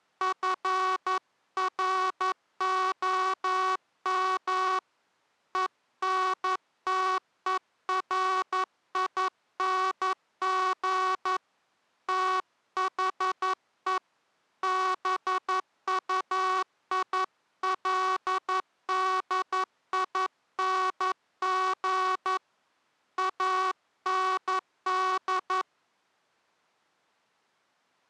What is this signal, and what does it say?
Morse code, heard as a buzzer, hand-sent with a paddle, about 11 wpm. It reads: FROM ENTERING THE BUILDING AND